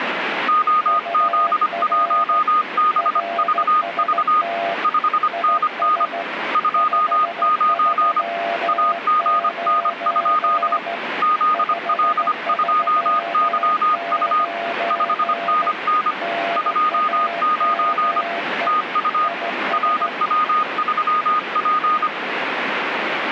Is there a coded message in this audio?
Yes: Morse code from 0.4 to 22.1 s, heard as two keyed tones, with radio static. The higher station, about 25 wpm, 1230 Hz: OZ1BVV 5NN 29 AGN? ZL2YU 5NN 29 TU RW3P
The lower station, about 15 wpm, 680 Hz: UR RST IS 539 539 NAME IS